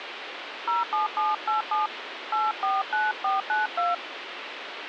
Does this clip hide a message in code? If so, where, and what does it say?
Yes: DTMF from 0.7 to 3.9 s, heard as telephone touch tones, dialled by hand, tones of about 160 ms, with phone line noise. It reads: 07787 849492